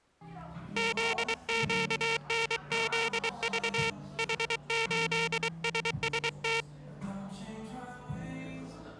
Morse code, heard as a buzzer, hand-sent with a paddle, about 23 wpm, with the noise of a cafe. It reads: ZQNZV H8SST